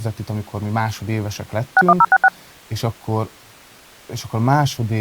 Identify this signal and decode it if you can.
DTMF, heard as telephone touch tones, dialled by machine, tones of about 50 ms, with speech in Hungarian. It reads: 61066